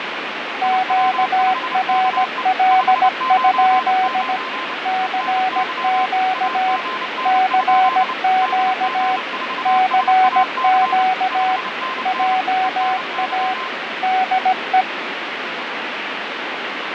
Morse code, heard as two keyed tones, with radio static and fading. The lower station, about 17 wpm, 750 Hz: QRL? CQ CQ CQ JA DE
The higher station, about 29 wpm, 1040 Hz: IW5KE 599 ENY AGN? DG4SAC 5NN ENY